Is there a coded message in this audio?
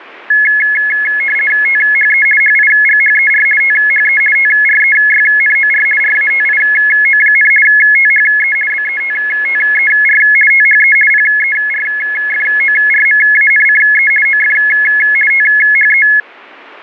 Yes: RTTY (50 baud, 450 Hz shift) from 0.3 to 16.2 s, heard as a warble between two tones, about 1950 Hz centre. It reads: THE HIGHER THE TREYNOR RATIO, THE BETTER THE PERFORMANCE OF THE